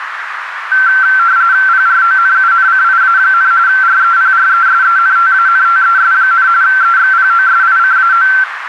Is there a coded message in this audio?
Yes: RTTY (45.45 baud, 170 Hz shift) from 0.7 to 8.4 s, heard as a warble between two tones, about 1450 Hz centre, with radio static and a narrow filter. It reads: PRONUNCIA, REPRESENTANTES, EXPOSICAO